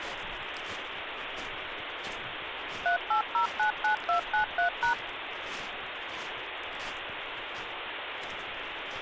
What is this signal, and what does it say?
DTMF, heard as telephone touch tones, dialled by machine, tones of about 110 ms, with phone line noise. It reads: 38099293#